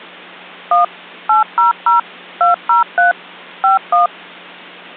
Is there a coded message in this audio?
Yes: DTMF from 0.7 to 4.1 s, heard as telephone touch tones, dialled by machine, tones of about 140 ms. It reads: 1 800 203 51